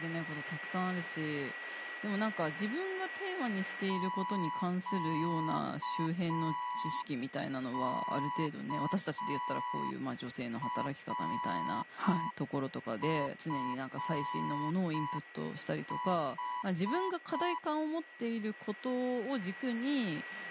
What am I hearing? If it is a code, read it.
Morse code, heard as a keyed tone, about 5 wpm, 990 Hz, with a steady whistle near 1930 Hz and speech in Japanese. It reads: QKRFH